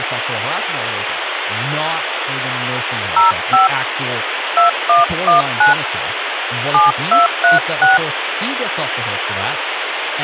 DTMF, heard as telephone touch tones, dialled by hand, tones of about 140 ms, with phone line noise and speech in English. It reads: 05 2119 7236